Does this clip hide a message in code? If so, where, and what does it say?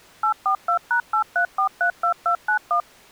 Yes: DTMF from 0.2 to 2.8 s, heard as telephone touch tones, dialled by machine, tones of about 90 ms. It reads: 842#83432291